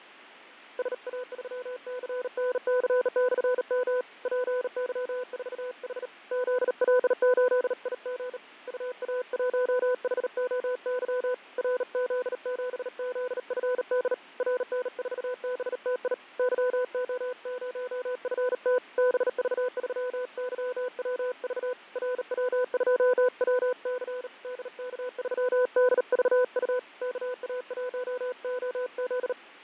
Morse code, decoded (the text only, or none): SA3CNC/M PY4H ZL8IG UA1HOY RZ7ZFD RN4BTI YO0FT BV3YWV RW2WC DK3DVU KA1OZ